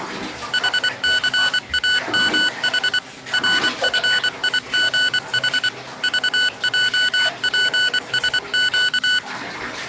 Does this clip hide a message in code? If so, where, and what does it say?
Yes: Morse code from 0.5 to 9.2 s, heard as electronic beeps, machine-sent, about 24 wpm, 1490 Hz, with the noise of a restroom. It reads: HCAMH RFIGH VJPSQ